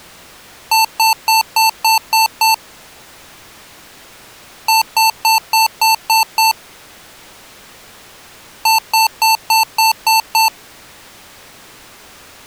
Beep code, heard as beeps from a small speaker, played three times, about 890 Hz. 7 short. In AMI BIOS tables: virtual mode exception error; in Dell tables: processor failure.